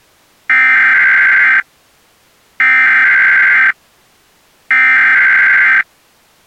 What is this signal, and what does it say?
Emergency Alert System (SAME) tones (header bursts), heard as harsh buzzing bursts, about 520.83 baud.